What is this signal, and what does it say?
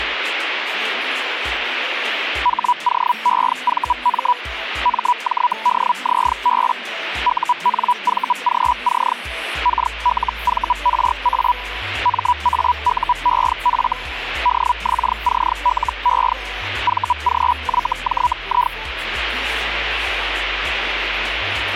Hellschreiber (Feld-Hell, 122.5 baud), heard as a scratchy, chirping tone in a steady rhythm, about 980 Hz. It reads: HOEVM MJDZB UNVGC KLVRA MAUEF DXCLE VGYJI